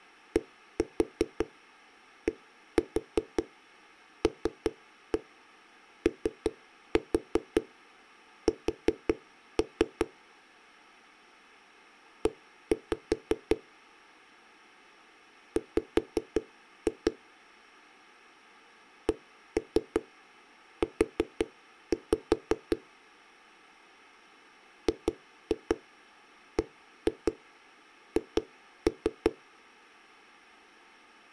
Tap code, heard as knocks on a wall, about 5 knocks a second. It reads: DDLOS E W CU GBH